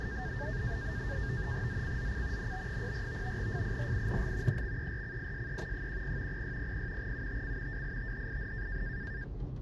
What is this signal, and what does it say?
NAVTEX (SITOR-B), 100 baud, 170 Hz shift, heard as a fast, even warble, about 1700 Hz centre, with the noise inside a car. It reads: ZCZC NB04 FIRING EXERCISE 10 0600 UTC WITHIN